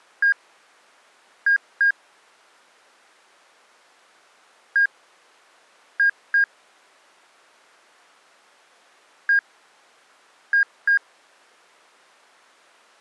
Beep code, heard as beeps, played three times, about 1600 Hz. 1-2.